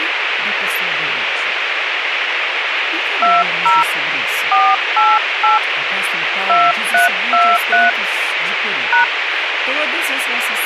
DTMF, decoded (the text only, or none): 20 488 2323 #